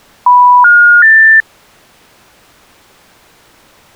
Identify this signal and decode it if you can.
Telephone call progress tone (North American plan), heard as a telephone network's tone, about 980, 1430, 1800 Hz. Special information tone.